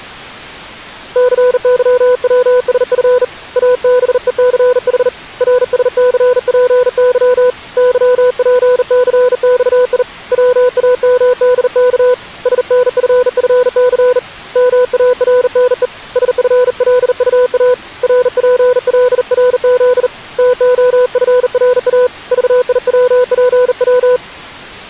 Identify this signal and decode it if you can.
Morse code, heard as a keyed tone, hand-sent with a bug key, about 39 wpm, 500 Hz. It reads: CYWSF ABECH RSCPY YPCXI WAMDK SNFFC MARNE SFLUA RPLRZ TOFRA VIWPW